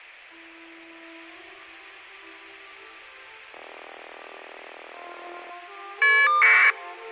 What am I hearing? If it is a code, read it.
Caller ID data burst, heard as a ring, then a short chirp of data, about 1200 baud.